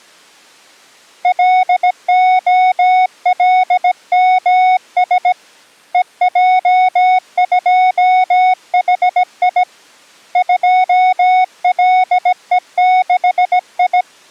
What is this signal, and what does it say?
Morse code, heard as a keyed tone, hand-sent with a bug key, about 17 wpm, 740 Hz. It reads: LOLMS EJ2HI 2LE6I